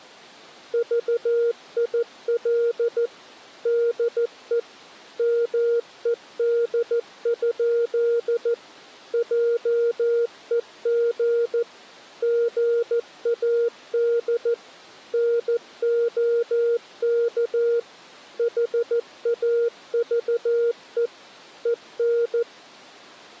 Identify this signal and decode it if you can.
Morse code, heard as a keyed tone, machine-sent, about 14 wpm, 470 Hz. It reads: VIL DE MED? JEG GAD NOK HAVE EN